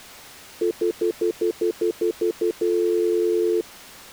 Telephone call progress tone (North American plan), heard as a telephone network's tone, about 350, 440 Hz, 0.1 s on and 0.1 s off. Stutter dial tone.